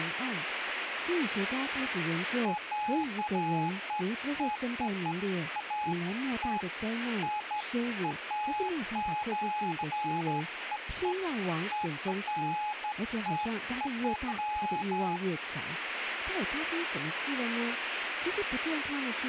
Beeps of irregular length, with radio static and speech in Chinese. There is no code.